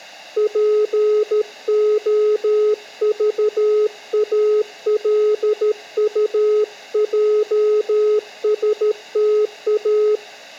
Morse code (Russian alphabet), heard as a keyed tone, hand-sent with a paddle, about 13 wpm, 420 Hz, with room echo. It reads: ПОЖАЛУЙСТА